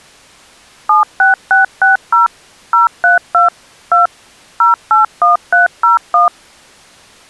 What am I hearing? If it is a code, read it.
DTMF, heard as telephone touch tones, dialled by machine, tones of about 140 ms. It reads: 76660 032 2 081301